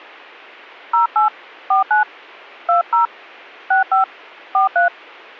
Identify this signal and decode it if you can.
DTMF, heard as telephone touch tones, dialled by hand, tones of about 130 ms. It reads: 08 49 20 65 43